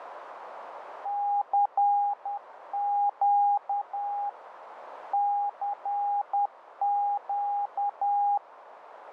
Morse code, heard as a keyed tone, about 10 wpm, 810 Hz, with radio static and a narrow filter. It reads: CQ CQ